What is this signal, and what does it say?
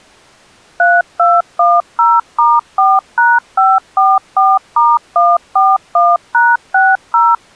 DTMF, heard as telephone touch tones, dialled by machine, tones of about 210 ms. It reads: 3210*4#544*141#60